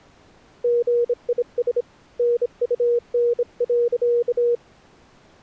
Morse code, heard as a keyed tone, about 26 wpm, 480 Hz. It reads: GIS NUN.